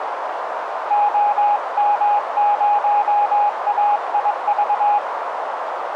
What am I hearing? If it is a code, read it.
Morse code, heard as a keyed tone, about 22 wpm, 830 Hz, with radio static and a narrow filter. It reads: OM0AIV